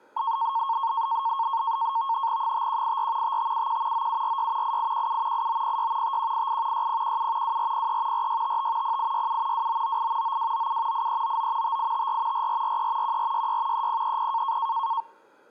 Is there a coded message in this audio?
Yes: NAVTEX (SITOR-B), 100 baud, 170 Hz shift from 0.2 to 15.0 s, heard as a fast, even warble, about 1000 Hz centre. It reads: 5184 5571 9746 8817 8906 5188 6017 2403 4655 0867 2998 9297 8399 5854 4443 1466 3030